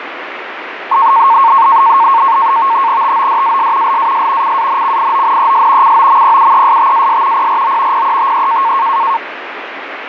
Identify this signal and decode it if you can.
NAVTEX (SITOR-B), 100 baud, 170 Hz shift, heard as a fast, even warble, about 1000 Hz centre, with radio static. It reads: TODAS LAS CANCIONES COMPUESTAS PRO PETE